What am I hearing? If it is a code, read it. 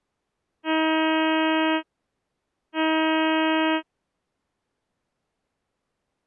Ship horn signal, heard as a ship's horn, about 320 Hz. 2 short. At sea: I am altering course to port.